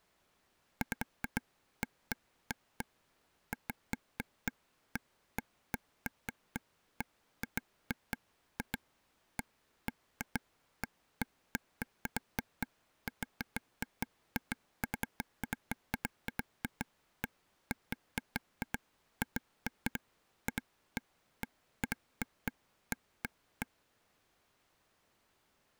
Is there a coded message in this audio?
No, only irregular taps on a table.